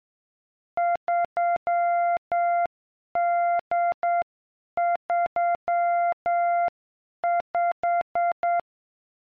Morse code (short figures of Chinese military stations), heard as a keyed tone, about 8 wpm, 690 Hz. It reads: 3835